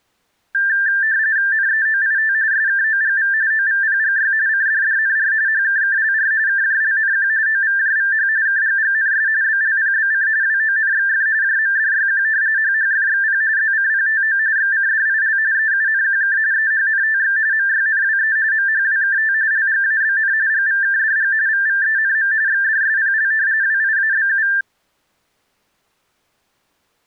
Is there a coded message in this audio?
Yes: RTTY (45.45 baud, 170 Hz shift) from 0.5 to 24.6 s, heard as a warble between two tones, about 1700 Hz centre. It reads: NEOIT SKOGV OVPGY CDDNR HKKLR KJLNQ OVJVH KGGNS BLPBC WONXF JMDYQ HHFXP ZCPTO XCDIL EUNQK EHNTX MYNWE MHWKT LGABN GVKDG VVENM XDSPL WIABU